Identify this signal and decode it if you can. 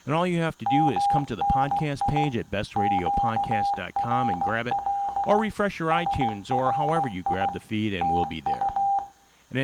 Morse code, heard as a keyed tone, machine-sent, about 16 wpm, 800 Hz, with room echo and speech in English. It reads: MNI QRL SRI TU